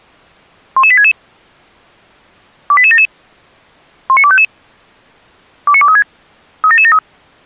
Five-tone selective call (ZVEI), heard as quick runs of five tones, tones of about 70 ms. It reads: 11866 28877 19255 29236 37773